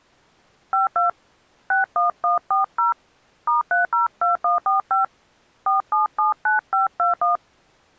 DTMF, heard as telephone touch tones, dialled by hand, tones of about 140 ms. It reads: 52 61140 *302145 4779521